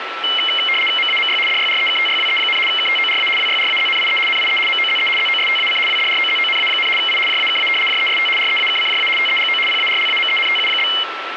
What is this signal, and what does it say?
RTTY (75 baud, 850 Hz shift), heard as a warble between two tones, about 2550 Hz centre, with radio static and a steady whistle near 1330 Hz. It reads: MAMY DYREKTYWE, KTORA WYRAZNIE NIE MOZE ZOSTAC WDROZONA, I JAKA JEST REAKCJA TEGO PARLAMENTU?